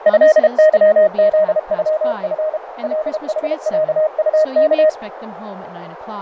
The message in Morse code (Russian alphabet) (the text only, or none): ЭЫЗЮФ ЛХЯУК